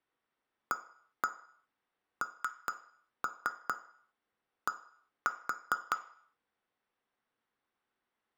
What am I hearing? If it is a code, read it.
Tap code, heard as taps on glass, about 4 knocks a second, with room echo. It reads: AND